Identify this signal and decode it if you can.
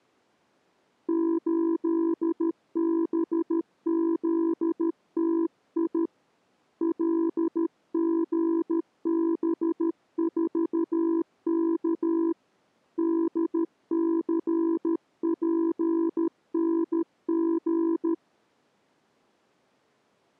Morse code, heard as a keyed tone, hand-sent with a paddle, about 13 wpm, 330 Hz. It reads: 8BZTI LGB4K DCPNG